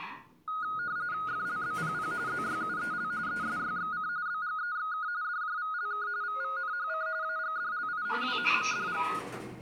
RTTY (45.45 baud, 170 Hz shift), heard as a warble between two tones, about 1350 Hz centre, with the noise inside a lift. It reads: FLBPP ZYUEL ESYXC BGEXK DJVLK VVNHC AGDLI WHMDG